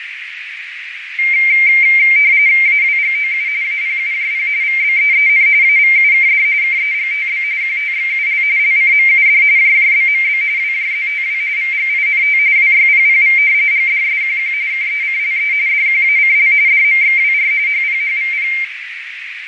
RTTY (45.45 baud, 170 Hz shift), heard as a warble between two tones, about 2200 Hz centre, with radio static, fading and a narrow filter. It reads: AWGOU APUJP VBEEN AVUKD KEGTB QTXUL LCMUD JJBMB WJZTW VGINT WYPPV GDSQQ KECLE DQACL DMXWR HPHVP